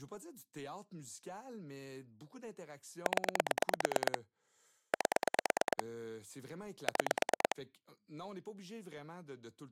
Pulse dialling, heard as clicks on a phone line, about 9 pulses a second, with speech in French. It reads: 0 8 6